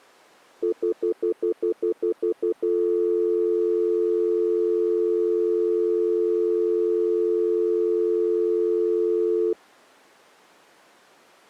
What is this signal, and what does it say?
Telephone call progress tone (North American plan), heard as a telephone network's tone, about 350, 440 Hz, 0.1 s on and 0.1 s off. Stutter dial tone.